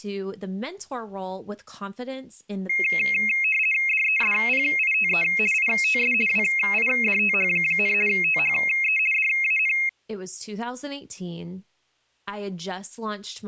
RTTY (50 baud, 450 Hz shift), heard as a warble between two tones, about 2350 Hz centre, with speech in English. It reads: DESPITE ITS WIDTH, THE DAN